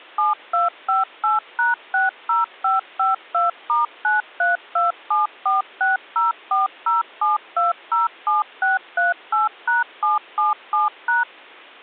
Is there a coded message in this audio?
Yes: DTMF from 0.2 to 11.2 s, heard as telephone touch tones, dialled by machine, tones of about 160 ms. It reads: 7258#60552*9327460407207638#777#